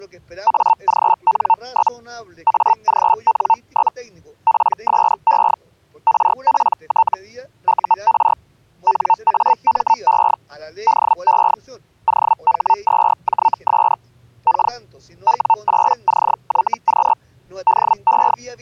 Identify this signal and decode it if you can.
Hellschreiber (Feld-Hell, 122.5 baud), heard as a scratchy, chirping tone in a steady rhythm, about 900 Hz. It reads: AGN? AGN? PSE RPT UR NAME DE OH2JS K W8CYQ DE